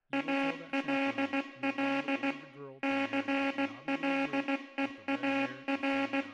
Morse code, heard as a buzzer, machine-sent, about 16 wpm, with room echo and speech in English. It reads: ALL CLEAR